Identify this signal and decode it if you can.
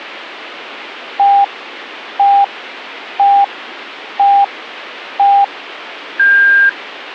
Radio time signal (five pips and a higher one, as on Chinese radio), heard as pips.